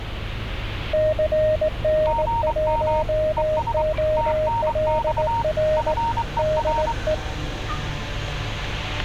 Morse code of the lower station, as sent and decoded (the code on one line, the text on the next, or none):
-.-. -. .---- --- .-.. .-. / -.. .
CN1OLR DE